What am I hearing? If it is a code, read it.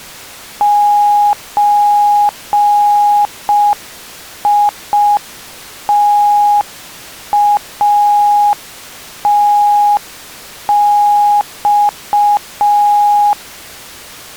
Morse code (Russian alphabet), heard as a keyed tone, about 5 wpm, 830 Hz. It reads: ЧИТАТЬ